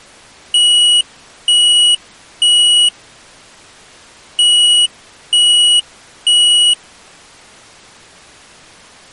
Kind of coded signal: alarm pattern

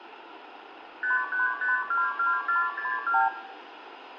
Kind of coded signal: multi-frequency trunk signalling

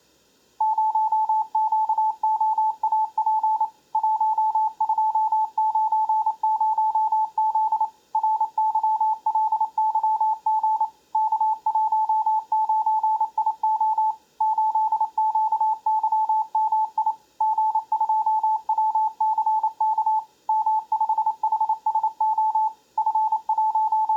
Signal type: Morse code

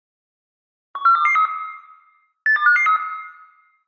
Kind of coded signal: five-tone selective call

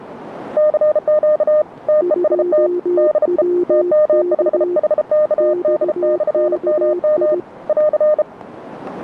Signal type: Morse code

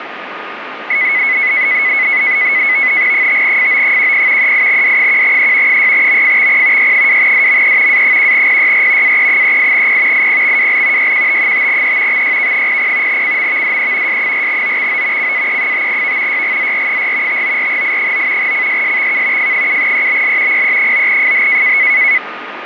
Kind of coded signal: NAVTEX (SITOR-B)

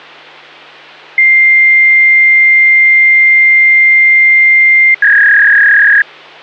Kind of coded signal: fax machine handshake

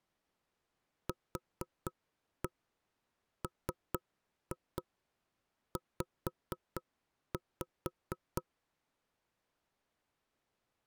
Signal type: tap code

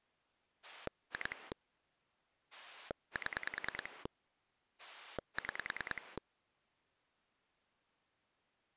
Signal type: pulse dialling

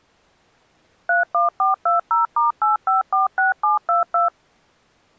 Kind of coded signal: DTMF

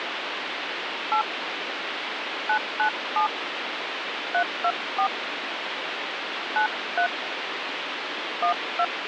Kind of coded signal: DTMF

